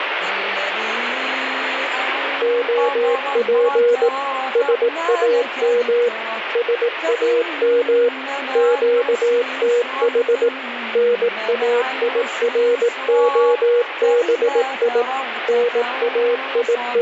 Morse code, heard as a keyed tone, machine-sent, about 18 wpm, 480 Hz, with radio static. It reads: OP SAM SAM QTH NAIROBI …